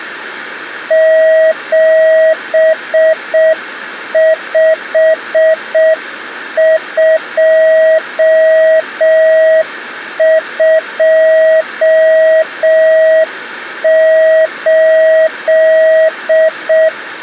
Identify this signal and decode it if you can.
Morse code, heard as a keyed tone, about 6 wpm, 640 Hz. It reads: 75228